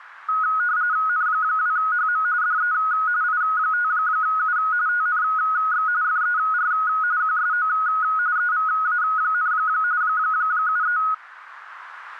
RTTY (45.45 baud, 170 Hz shift), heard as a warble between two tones, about 1360 Hz centre. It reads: N2HM DE I5U TNX FER QSO EVA, 73